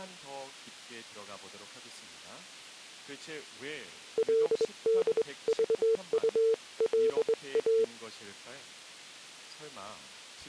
Morse code (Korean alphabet), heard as a keyed tone, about 21 wpm, 450 Hz. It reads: 그리고